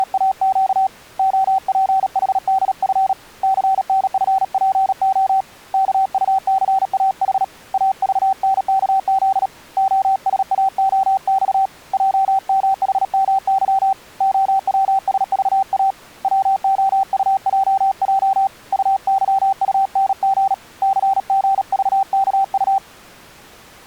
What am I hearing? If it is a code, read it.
Morse code, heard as a keyed tone, hand-sent with a paddle, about 37 wpm, 770 Hz. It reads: … OPHDF CNFPO KUCAH AVNKZ OSAOX JMHMY OWSVA WOUJJ UYUNG CGVKU